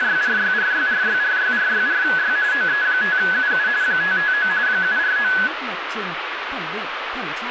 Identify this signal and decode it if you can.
RTTY (45.45 baud, 170 Hz shift), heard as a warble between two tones, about 1600 Hz centre, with radio static and speech in Vietnamese. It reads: … OE5UU 559 749